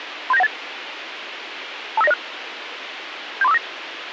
Five-tone selective call (EIA), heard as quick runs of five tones, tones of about 30 ms, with radio hiss. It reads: 37918 25906 73459